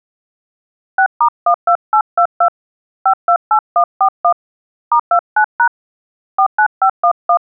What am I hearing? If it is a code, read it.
DTMF, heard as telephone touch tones, dialled by hand, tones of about 80 ms. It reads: 6*12822 528141 *29# 49511